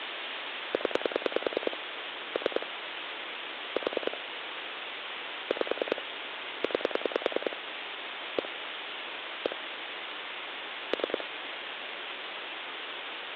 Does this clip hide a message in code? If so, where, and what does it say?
Yes: pulse dialling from 0.7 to 11.2 s, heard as clicks on a phone line, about 10 pulses a second, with phone line noise. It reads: 0 3 4 5 9 1 1 3